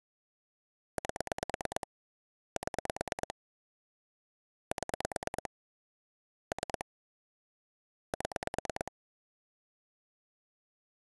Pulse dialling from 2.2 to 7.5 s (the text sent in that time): 7 7 3